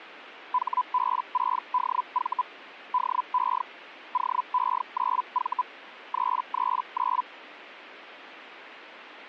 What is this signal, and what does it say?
Hellschreiber (Feld-Hell, 122.5 baud), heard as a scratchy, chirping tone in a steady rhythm, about 1000 Hz. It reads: HB6DV DE OE9V 339